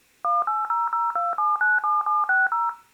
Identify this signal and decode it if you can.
DTMF, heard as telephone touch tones, dialled by machine, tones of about 180 ms, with room echo. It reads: 18002797760